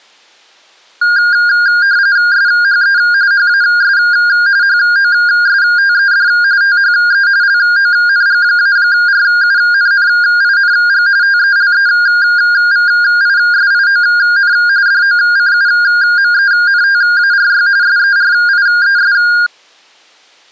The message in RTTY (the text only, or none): SHE HAS HOSTED THE LONG-RUNNING TELEVISION DOCUMENTARY SERIES